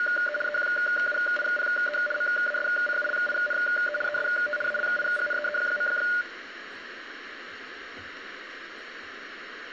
RTTY (75 baud, 850 Hz shift), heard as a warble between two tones, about 1020 Hz centre, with radio static and room echo. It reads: … EQUIPE MASCULINE EST ALIGNEE.